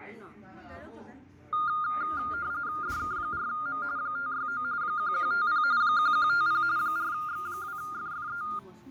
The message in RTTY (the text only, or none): DK4M 569 1150 1150 4X2FFE